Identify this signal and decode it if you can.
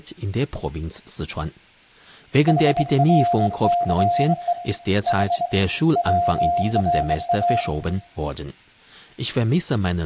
Morse code (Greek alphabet), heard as a keyed tone, hand-sent with a straight key, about 23 wpm, 700 Hz, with room echo and speech in German. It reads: ΗΡΘΕ Η ΩΡΑ